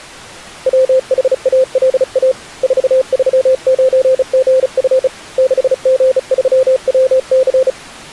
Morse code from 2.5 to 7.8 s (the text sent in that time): 439GF 6G3WC